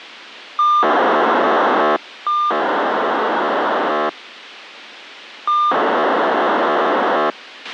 POCSAG pager data (2400 baud), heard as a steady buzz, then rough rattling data, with radio hiss and a squelch burst at the end.